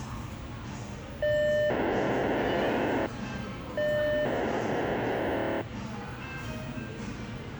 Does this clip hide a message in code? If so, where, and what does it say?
Yes: POCSAG pager data (1200 baud) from 1.2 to 5.6 s, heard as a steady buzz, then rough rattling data, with the noise of a crowd indoors.